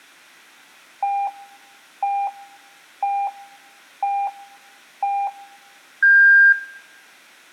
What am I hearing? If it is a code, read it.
Radio time signal (five pips and a higher one, as on Chinese radio), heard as pips, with room echo.